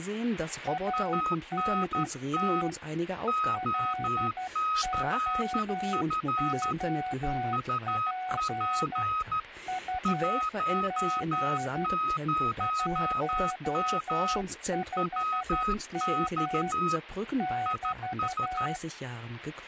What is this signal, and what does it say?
Morse code, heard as two keyed tones, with speech in German. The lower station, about 12 wpm, 740 Hz: ANT LOOP UP 15M <BT>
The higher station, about 13 wpm, 1260 Hz: ANT OCF UP 10M WX IS